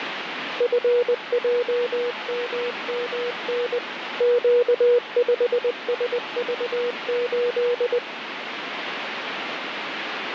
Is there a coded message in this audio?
Yes: Morse code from 0.5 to 8.0 s, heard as a keyed tone, machine-sent, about 20 wpm, 480 Hz, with radio static. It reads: FJMMN Q5SV8